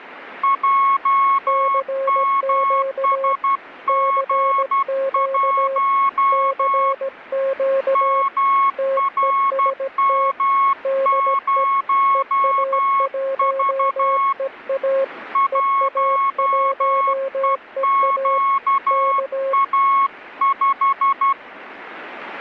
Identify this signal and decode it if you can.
Morse code, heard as two keyed tones. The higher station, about 12 wpm, 1100 Hz: JMSG1 MRM0V 1EQA5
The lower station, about 17 wpm, 540 Hz: CQ CQ CQ TEST DE EA1EA EA1EA K